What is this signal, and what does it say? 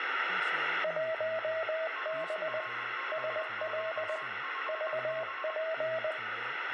Morse code, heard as two keyed tones, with radio static, room echo and speech in Bodo. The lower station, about 20 wpm, 640 Hz: 1B SL VP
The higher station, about 23 wpm, 1080 Hz: UR5QFB